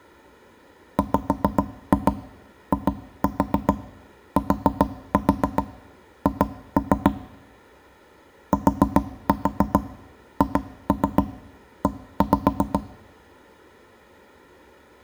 Tap code, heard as knocks on wood, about 7 knocks a second. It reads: WITH THE